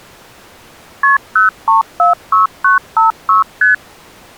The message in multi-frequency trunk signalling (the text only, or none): KP 0346956 ST